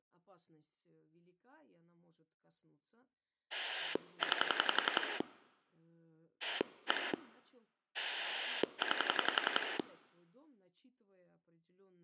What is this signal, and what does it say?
Pulse dialling, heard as a rotary dial, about 11 pulses a second, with speech in Russian. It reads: 9 1 9